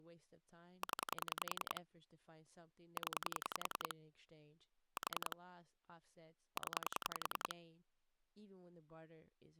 Pulse dialling, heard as clicks on a phone line, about 10 pulses a second, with speech in English. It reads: 0 0 4 0